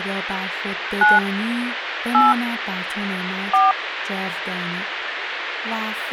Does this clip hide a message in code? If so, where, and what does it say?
Yes: DTMF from 1.0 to 3.7 s, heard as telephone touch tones, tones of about 180 ms, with phone line noise and speech in Persian. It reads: 9 8 4